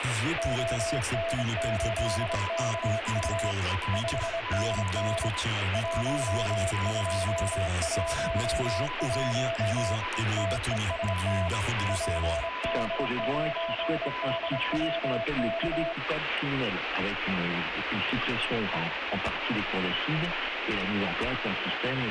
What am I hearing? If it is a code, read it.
Morse code, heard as two keyed tones, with radio static. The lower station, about 26 wpm, 670 Hz: ON8KU 5NN 1211 TEST PD9DWK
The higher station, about 19 wpm, 1000 Hz: QRL? CQ DX DE PD8NX